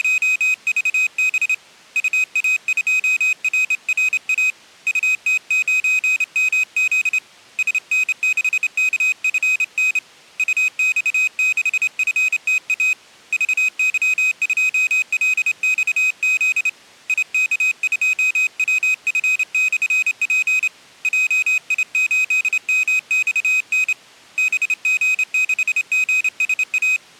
Morse code, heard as a high beeper, hand-sent with a straight key, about 28 wpm, 2500 Hz. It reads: … UA2RRA UT9MZ SN6KFN UX6FTA VY2LXZ IK2WF/P JI8MXN BG6GSA